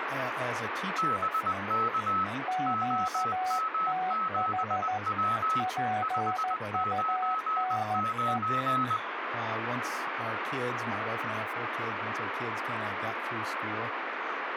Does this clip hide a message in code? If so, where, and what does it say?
Yes: Morse code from 0.9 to 9.0 s, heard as two keyed tones, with radio static. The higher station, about 20 wpm, 1290 Hz: BK OM7W 599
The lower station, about 14 wpm, 740 Hz: QTH PUNE